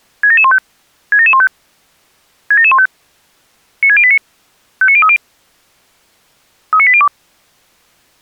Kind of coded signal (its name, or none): five-tone selective call